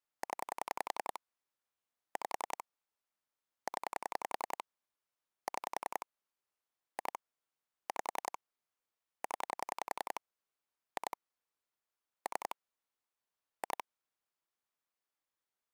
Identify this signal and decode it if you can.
Pulse dialling, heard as clicks on a phone line, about 10 pulses a second. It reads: 0 5 0 6 2 5 0 2 3 2